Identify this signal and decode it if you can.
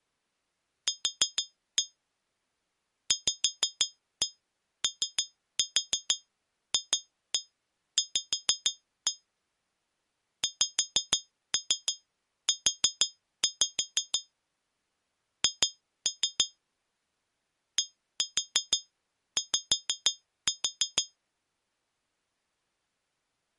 Tap code, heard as taps on glass, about 6 knocks a second. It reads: Q VOFV XU H DY